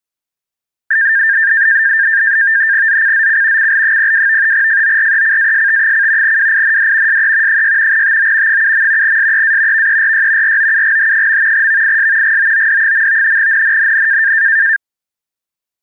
NAVTEX (SITOR-B), 100 baud, 170 Hz shift, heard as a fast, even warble, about 1700 Hz centre. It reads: ZCZC CL02 FORECAST: WIND SE 6 TO 7. SEA VERY ROUGH. VIS GOOD. NNNN